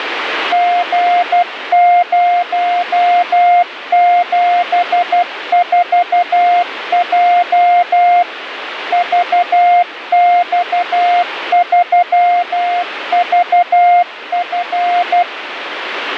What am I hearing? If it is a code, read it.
Morse code, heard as a keyed tone, machine-sent, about 12 wpm, 710 Hz, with radio static. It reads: G074J VX3VF